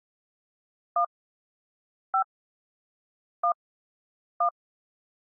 DTMF, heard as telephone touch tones, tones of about 90 ms. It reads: 1 5 1 1